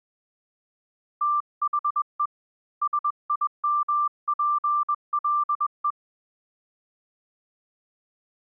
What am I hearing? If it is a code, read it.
Morse code, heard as a keyed tone, hand-sent with a paddle, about 21 wpm, 1180 Hz. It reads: THE SIMPLE